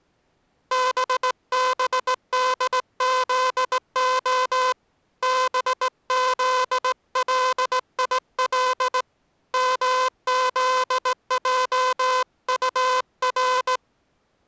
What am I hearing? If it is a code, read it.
Morse code, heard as a buzzer, hand-sent with a straight key, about 18 wpm. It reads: BBDZO BZLIL MZJUR